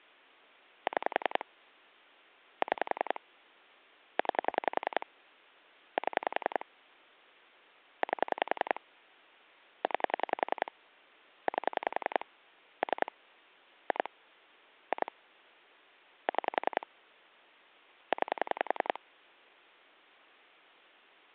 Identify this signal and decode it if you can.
Pulse dialling, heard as clicks on a phone line, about 10 pulses a second. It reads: 6 6 9 7 8 9 8 3 2 2 6 9